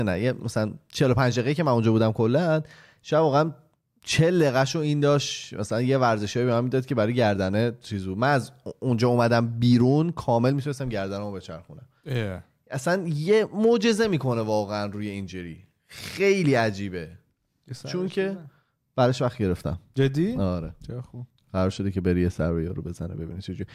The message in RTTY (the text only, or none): none